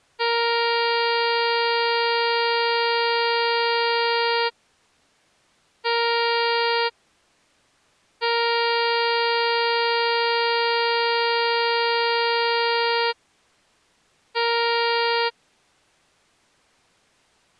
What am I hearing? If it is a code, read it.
Ship horn signal, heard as a ship's horn, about 470 Hz. 1 long, 1 short, 1 long, 1 short. At sea: I agree to be overtaken.